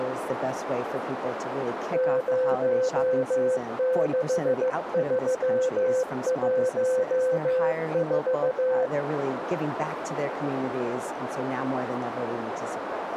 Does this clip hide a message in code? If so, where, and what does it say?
Yes: Morse code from 1.9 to 8.9 s, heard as a keyed tone, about 15 wpm, 510 Hz, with radio static and a narrow filter. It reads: 06314